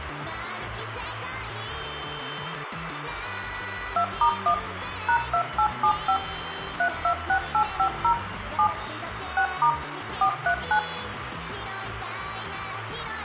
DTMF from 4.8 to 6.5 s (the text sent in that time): #2875